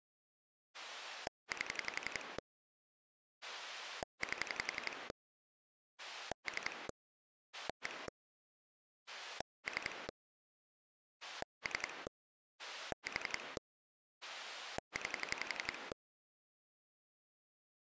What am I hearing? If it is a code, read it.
Pulse dialling, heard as a rotary dial, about 11 pulses a second. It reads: 8 8 3 1 3 3 4 9